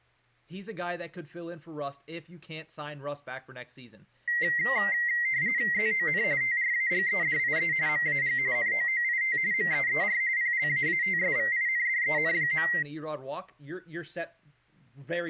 RTTY (45.45 baud, 170 Hz shift), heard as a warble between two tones, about 2000 Hz centre, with speech in English. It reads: ZON TRAGEDIE MAG NOOIT MEER PLAATSVINDEN.